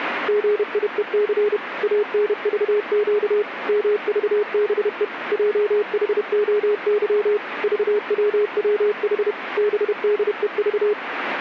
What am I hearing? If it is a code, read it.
Morse code, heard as a keyed tone, machine-sent, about 31 wpm, 420 Hz, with radio static. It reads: GIEC ANVQ MVBE JHOY VWWH BDEV